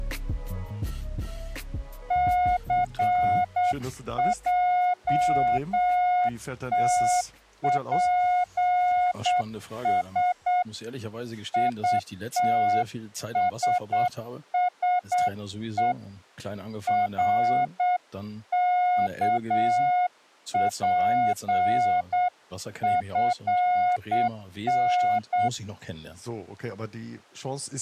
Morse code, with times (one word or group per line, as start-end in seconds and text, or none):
2.1-10.6 CJTPS
11.5-15.9 ITSSE
16.9-25.5 RKPFN